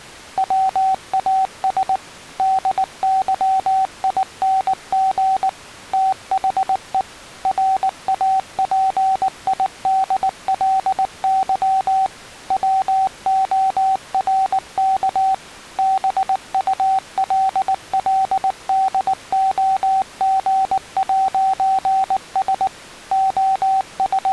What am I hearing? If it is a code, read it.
Morse code, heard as a keyed tone, machine-sent, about 19 wpm, 770 Hz. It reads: WAS DYING THE RAPIDLY WORK BULLDOG'S …